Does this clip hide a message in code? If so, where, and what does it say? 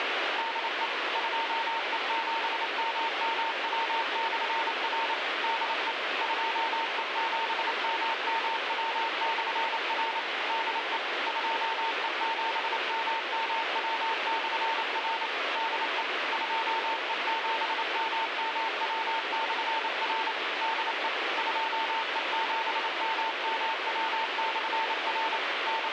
Yes: Morse code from 0.3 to 25.9 s, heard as a keyed tone, machine-sent, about 28 wpm, 900 Hz, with heavy radio static. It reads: DE 2E7MMW/R DE 2E7MMW/R DE 2E7MMW/R DE 2E7MMW/R DE 2E7MMW/R …